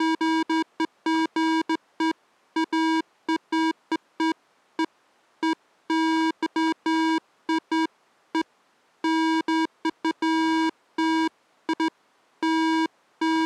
Beeps of irregular length. There is no code.